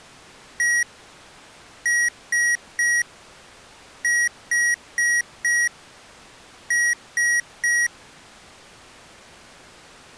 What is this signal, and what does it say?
Beep code, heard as beeps from a small speaker, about 1900 Hz. 1-3-4-3. In Phoenix BIOS tables: memory failure on data bits.